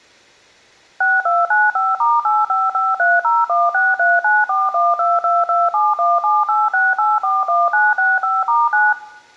DTMF, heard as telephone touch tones, dialled by machine, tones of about 200 ms, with room echo. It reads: 6295*8553016394122271786841965*9